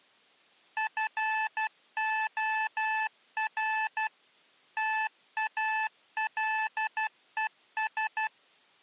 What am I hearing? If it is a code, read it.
Morse code, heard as electronic beeps, machine-sent, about 12 wpm, 870 Hz. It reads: FOR TALES